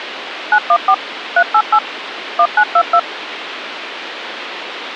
DTMF, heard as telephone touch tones, dialled by machine, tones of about 70 ms, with radio hiss. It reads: 914 388 1922